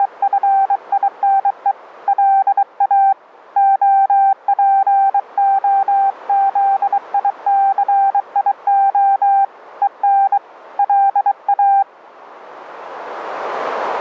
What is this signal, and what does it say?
Morse code, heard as a keyed tone, hand-sent with a bug key, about 23 wpm, 780 Hz, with radio static. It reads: … LA OPOZICIO EN LA